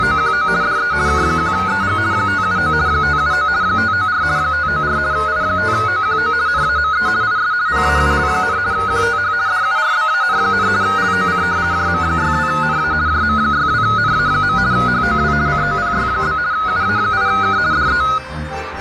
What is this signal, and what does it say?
RTTY (50 baud, 170 Hz shift), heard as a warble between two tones, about 1360 Hz centre, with radio static and a narrow filter. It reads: … DE K1EG 579 579 594 594 I5OQO NAME IS PAUL, QTH DURBAN, LOC JM62NA JM62NA. HOW COPY? UA8K DE